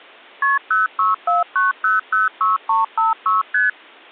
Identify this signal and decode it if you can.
Multi-frequency trunk signalling (R1, as on North American trunks), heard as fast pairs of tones, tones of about 160 ms. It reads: KP 0649006356 ST